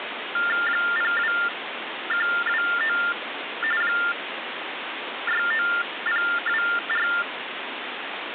TTY/TDD text telephone tones (45.45 baud Baudot), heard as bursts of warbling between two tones, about 400 Hz shift, 1600 Hz centre, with phone line noise. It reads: 02129 69024